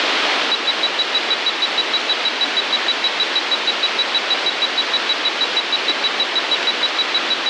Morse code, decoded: none

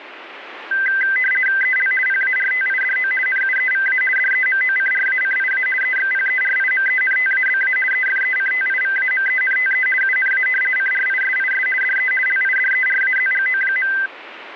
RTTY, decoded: EL PARTIDO NUEVA DEMOCRACIA EXPERIMENTABA EFECTIVAMENTE UNA CRISIS DE LIDERAZGO.

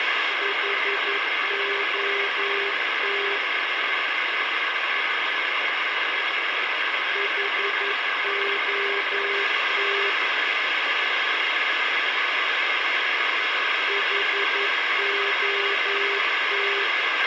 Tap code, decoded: none

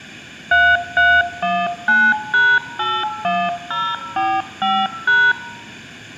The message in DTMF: 3319#81045#

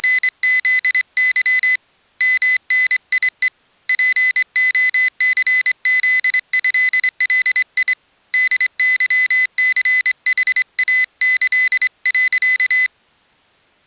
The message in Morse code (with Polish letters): … MNIE POCZĘLI DYCHAĆ.

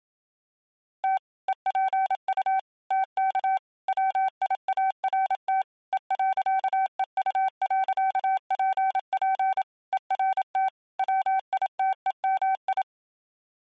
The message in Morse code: T EPU TK WIART E.EU.PP ERT WITEMI

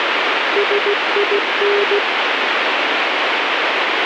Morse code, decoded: SIN

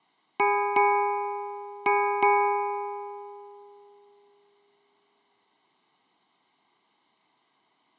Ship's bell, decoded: 4

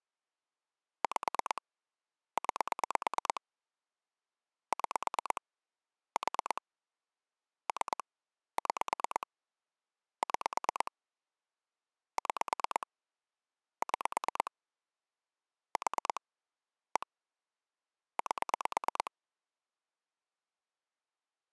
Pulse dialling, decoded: 5 9 6 4 3 6 6 6 6 4 1 8

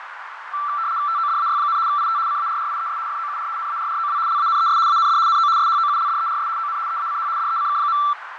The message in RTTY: TODAY, IT CARRIES FOUR NARROW LANES AND NO SHOULDERS ON EACH DECK.

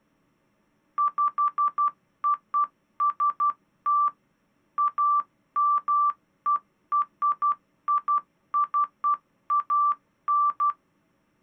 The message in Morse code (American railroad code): POST AMERICAN

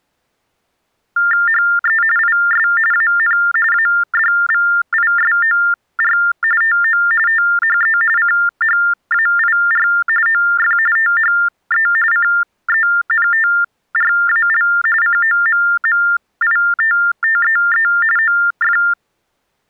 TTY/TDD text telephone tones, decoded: HE IS AN ADVISOR TO THE CHAIR OF THE CENTRAL COMMITTEE OF

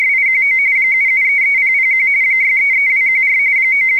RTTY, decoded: … 7733001 633214 …

